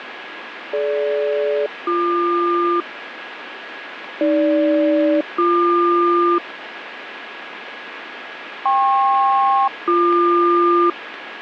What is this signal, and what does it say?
Aircraft SELCAL, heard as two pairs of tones, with radio static. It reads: DG-BQ AG-BQ KP-BQ